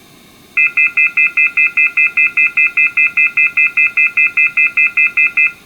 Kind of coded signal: telephone call progress tone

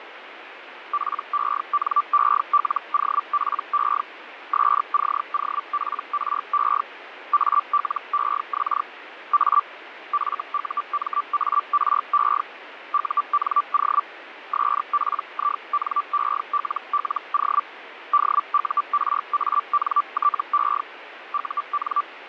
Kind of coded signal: Hellschreiber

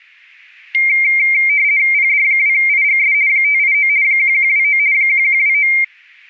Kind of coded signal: RTTY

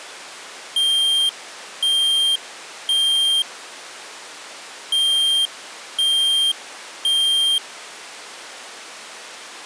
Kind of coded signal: alarm pattern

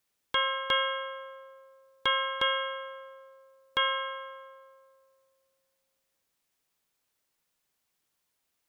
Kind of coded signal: ship's bell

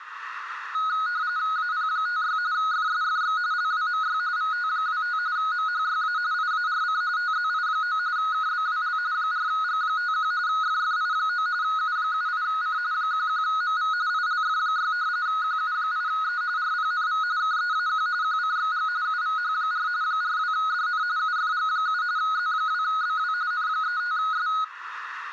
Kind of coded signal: RTTY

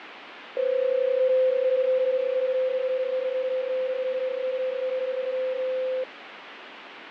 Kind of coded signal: PSK31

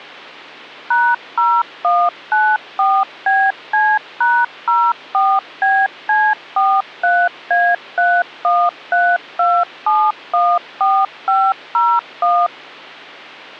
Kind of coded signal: DTMF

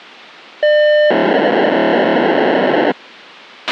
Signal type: POCSAG pager data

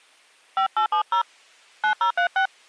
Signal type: DTMF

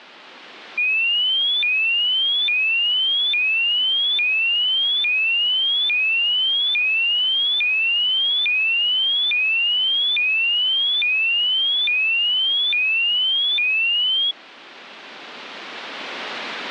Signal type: none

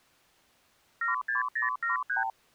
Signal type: multi-frequency trunk signalling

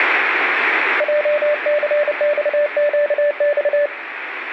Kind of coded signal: Morse code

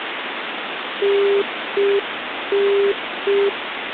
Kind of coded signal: telephone call progress tone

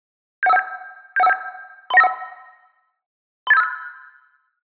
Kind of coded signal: five-tone selective call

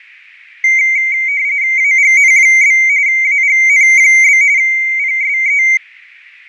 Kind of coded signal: RTTY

